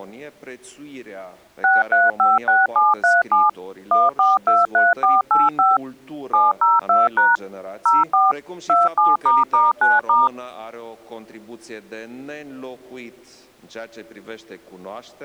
DTMF, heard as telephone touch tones, dialled by machine, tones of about 180 ms. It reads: 6356737 1423485 702# 04 27**9*